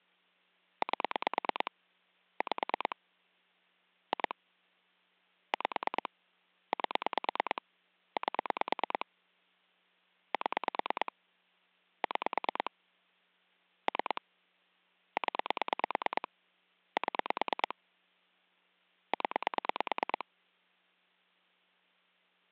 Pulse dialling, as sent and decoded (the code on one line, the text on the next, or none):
8 / 5 / 2 / 5 / 8 / 8 / 7 / 6 / 3 / 10 / 7 / 10
8 5 2 5 8 8 7 6 3 0 7 0